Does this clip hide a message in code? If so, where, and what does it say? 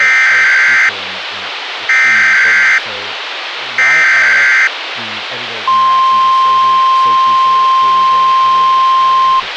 Yes: Emergency Alert System (SAME) tones (header bursts, then the 1050 Hz attention tone) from 0.0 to 9.4 s, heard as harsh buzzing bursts, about 520.83 baud, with radio hiss and speech in English.